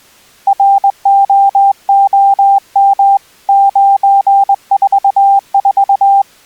Morse code, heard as a keyed tone, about 21 wpm, 790 Hz. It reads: ROOM 944